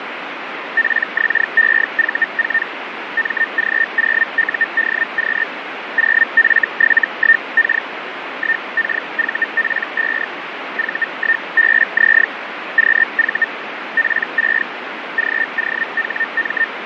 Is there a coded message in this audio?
Yes: Hellschreiber (Feld-Hell, 122.5 baud) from 0.8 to 16.6 s, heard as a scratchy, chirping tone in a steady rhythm, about 1800 Hz, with radio static and fading. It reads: PXEV4 MG0UDQ 0F71K 1KVP5 V1BZ QV P6 GOHM